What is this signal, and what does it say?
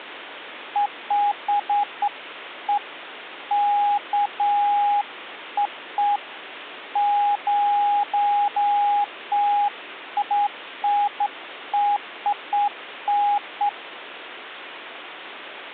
Beeps of irregular length. There is no code.